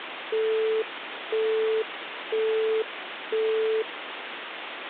Telephone call progress tone (single-tone plan, as in Europe, Japan and elsewhere), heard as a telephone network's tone, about 440 Hz, 0.5 s on and 0.5 s off, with phone line noise. Busy tone.